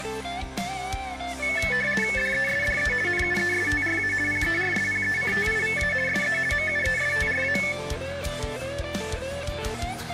RTTY (50 baud, 450 Hz shift), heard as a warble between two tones, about 2000 Hz centre. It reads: DESDE NUESTRA PERSPECTIVA SE MUESTRA